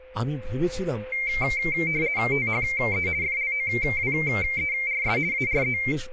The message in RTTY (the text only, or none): THE FLOWERS ARE